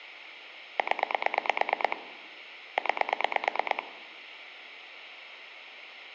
Pulse dialling, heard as clicks on a phone line, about 9 pulses a second, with phone line noise. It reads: 0 9